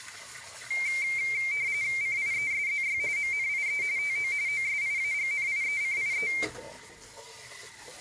RTTY (45.45 baud, 170 Hz shift), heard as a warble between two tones, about 2200 Hz centre, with kitchen noise. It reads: CIESZY MNIE TO OSIAGNIECIE